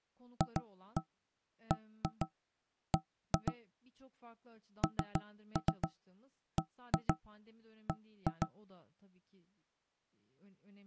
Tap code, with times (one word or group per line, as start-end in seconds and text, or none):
0.4-3.5 FBB
4.8-8.5 NBB